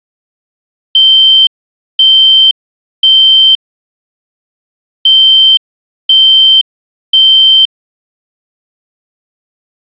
Alarm pattern, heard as an alarm's beeps, played twice, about 3100 Hz. Temporal three. Smoke or fire, evacuate.